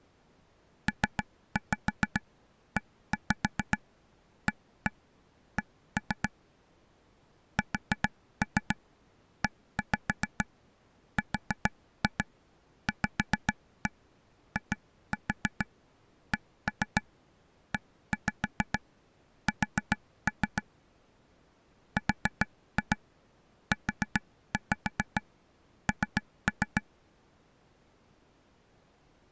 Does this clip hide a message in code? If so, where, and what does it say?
Yes: tap code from 0.9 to 26.8 s, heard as taps on a table, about 7 knocks a second. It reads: PEAK SERVICES RUN